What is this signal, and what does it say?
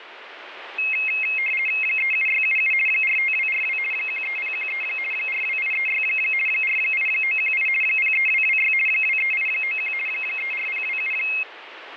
RTTY (50 baud, 450 Hz shift), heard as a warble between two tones, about 2350 Hz centre, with radio static. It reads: 37677 45242 13013 42836 48918 03226 23891 34027